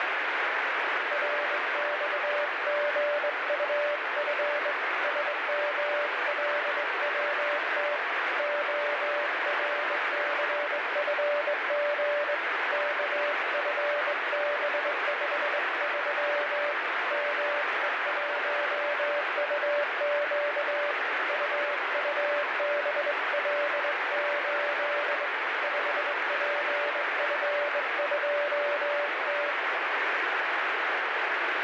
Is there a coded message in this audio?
Yes: Morse code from 1.1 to 29.6 s, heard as a keyed tone, hand-sent with a straight key, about 21 wpm, 580 Hz, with heavy radio static. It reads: RXGUF SMLWT ORCFG KFB53 ME1UQ UUBL8 5PF2T